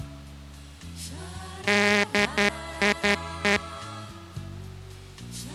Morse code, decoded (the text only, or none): DIE